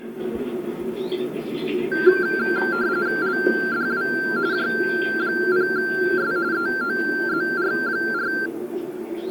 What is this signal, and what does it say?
RTTY (45.45 baud, 170 Hz shift), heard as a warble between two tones, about 1470 Hz centre, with the noise of a park. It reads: LDW J0S EOZR4